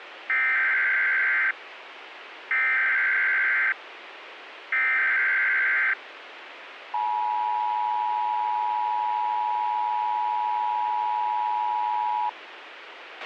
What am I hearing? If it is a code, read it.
Emergency Alert System (SAME) tones (header bursts, then the 853 and 960 Hz attention tone), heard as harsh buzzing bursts, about 520.83 baud, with radio hiss and a squelch burst at the end.